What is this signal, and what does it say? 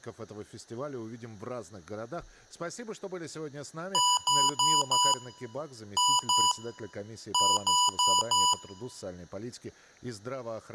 Beep code, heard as beeps from a small speaker, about 990 Hz, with speech in Russian. 4-2-4. In Phoenix BIOS tables: unexpected interrupt in protected mode.